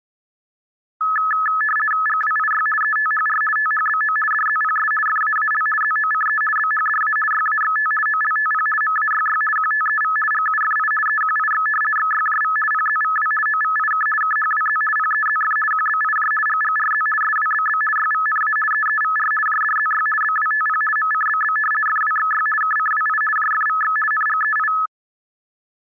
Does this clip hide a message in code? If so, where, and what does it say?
Yes: RTTY (50 baud, 450 Hz shift) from 1.0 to 24.9 s, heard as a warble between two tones, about 1500 Hz centre. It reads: GWIY ETHR THBO DZPS FAAL ZOCE BHDA YAXT OLTP MAYY QTEV GUFI EQIX XYJV PZVW OVIK KHWZ PEZF QBIJ GGRZ SWBB YVNA EEVR JDZY BWTP MCBB FWXY KCWI JFVX NGEI